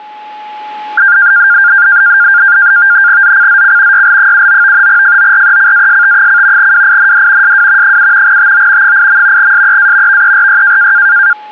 NAVTEX (SITOR-B), 100 baud, 170 Hz shift, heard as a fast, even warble, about 1500 Hz centre, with a steady whistle near 850 Hz. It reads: ZCZC YL79 FORECAST: WIND SW 7 TO 8. SEA VERY